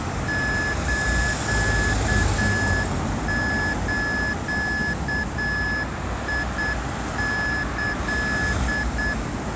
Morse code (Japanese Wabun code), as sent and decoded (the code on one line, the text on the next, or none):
---.- ---.- .. -.-..
スズキ